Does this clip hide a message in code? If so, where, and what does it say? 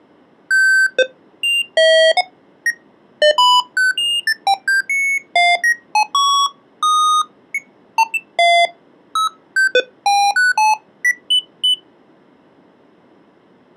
No, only electronic bleeps of random pitch and length.